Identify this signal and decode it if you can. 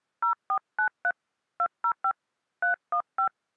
DTMF, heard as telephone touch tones, dialled by hand, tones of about 90 ms. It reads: 0493 205 315